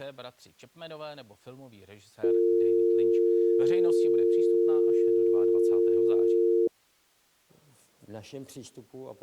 Telephone call progress tone (North American or UK plan), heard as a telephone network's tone, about 350, 450 Hz, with speech in Czech. Dial tone.